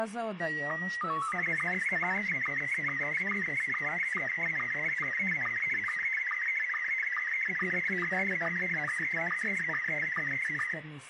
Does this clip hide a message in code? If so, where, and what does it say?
Yes: SSTV (slow-scan television), Scottie S1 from 0.4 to 10.7 s, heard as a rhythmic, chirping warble, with room echo.